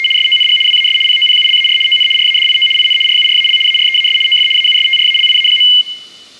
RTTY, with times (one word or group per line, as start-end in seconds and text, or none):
0.0-0.1 …
0.2-0.6 SONG
0.7-1.0 WAS
1.1-1.8 POPULAR
1.9-2.1 ON
2.2-2.7 RADIO
2.8-3.0 IN
3.1-3.6 RURAL
3.7-4.2 AREAS
4.3-4.5 OF
4.6-5.7 AUSTRALIA.